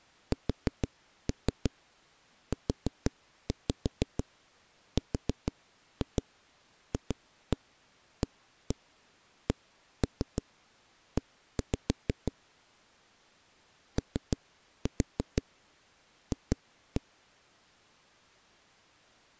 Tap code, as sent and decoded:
4-3 4-5 4-2 2-1 1-1 1-3 1-5 / 3-4 2-1
SURFACE OF

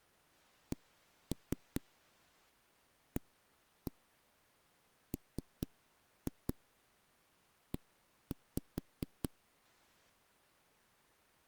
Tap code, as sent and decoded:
1-3 1-1 3-2 1-5
CAME

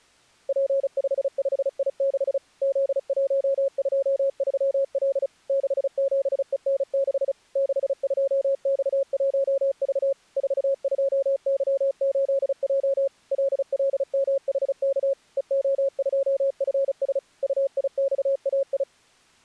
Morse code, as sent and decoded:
.--. ..... ..... .. -.... / --.. .---- ..--- ...-- .-.. / -.... --... . -. -.... / -.... ..--- -..- .---- ...- / ....- ..--- -.-- ---.. .--- / .-.. .-.. -- .... -.- / . --- ..--- ..-. ... / ..- .. -..- .- ..
P55I6 Z123L 67EN6 62X1V 42Y8J LLMHK EO2FS UIXAI

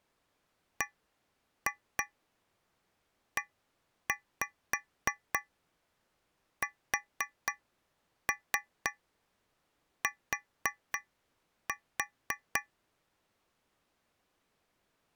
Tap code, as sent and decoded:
1-2 1-5 4-3 4-4
BEST

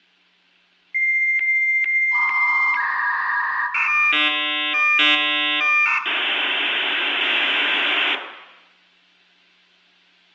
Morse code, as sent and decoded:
none

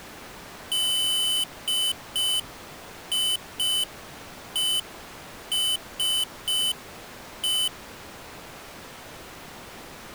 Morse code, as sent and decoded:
-.. .. . ... .
DIESE

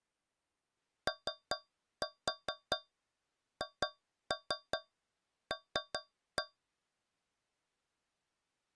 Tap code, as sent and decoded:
3-4 2-3 3-1
OHL

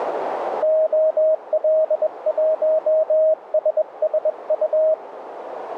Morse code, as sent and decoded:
--- .-.. .---- ... ... ..-
OL1SSU

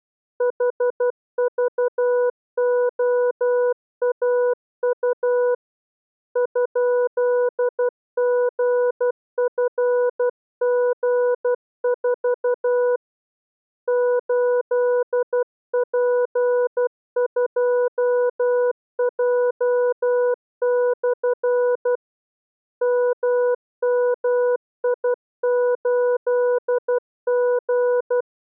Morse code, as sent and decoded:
.... ...- --- .- ..- / ..--.. --. ..-. --. ....- / ---.. .--. ..--- .--- -..-. / -- -- .. ---.. --.
HVOAU ?GFG4 8P2J/ MMI8G

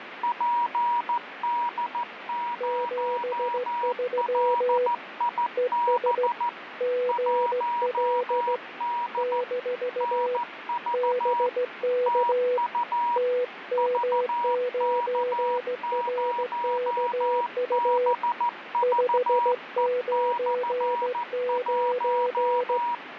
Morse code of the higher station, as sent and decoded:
.--. -.. ----- .-.. .. -... / .---- -.. / -. ...- / - ..- / ...- -.- ----- -... ...- . -..-. .----
PD0LIB 1D NV TU VK0BVE/1

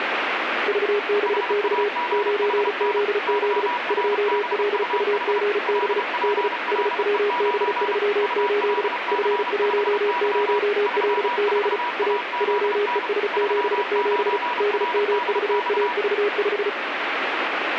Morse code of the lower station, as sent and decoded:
...- -... -..- / ----. --.. --.. / ..--- .-.. ..- --. -... / -.. / ... .-- -... ...-- ---.. / ..-. .---- ----- .-.. --.. / .- / .--- . ... --... --... / -.. -- ...- .- ...- .....
VBX 9ZZ 2LUGB D SWB38 F10LZ A JES77 DMVAV5

